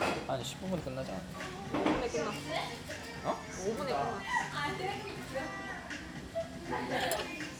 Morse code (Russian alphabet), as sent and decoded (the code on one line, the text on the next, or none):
none